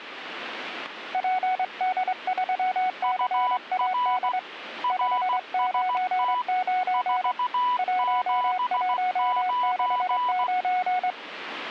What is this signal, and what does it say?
Morse code, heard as two keyed tones. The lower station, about 24 wpm, 740 Hz: PD3CAD 599 1169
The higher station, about 16 wpm, 990 Hz: UR RST 479